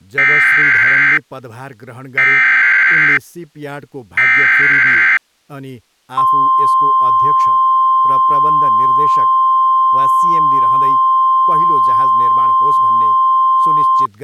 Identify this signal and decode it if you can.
Emergency Alert System (SAME) tones (header bursts, then the 1050 Hz attention tone), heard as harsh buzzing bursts, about 520.83 baud, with speech in Nepali.